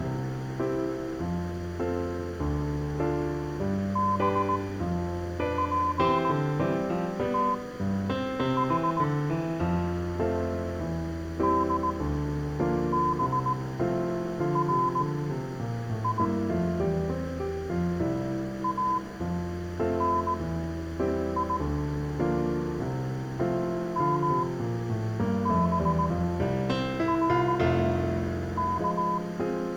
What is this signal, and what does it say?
Morse code (Hebrew alphabet), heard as a keyed tone, machine-sent, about 18 wpm, spaced as for 7 wpm, 1010 Hz, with room echo. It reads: בפתח דברי אני מברך